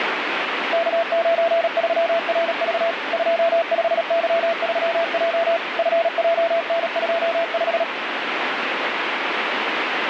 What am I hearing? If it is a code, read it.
Morse code, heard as a keyed tone, machine-sent, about 37 wpm, 670 Hz, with radio static. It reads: K93RV 25Y3J FJN25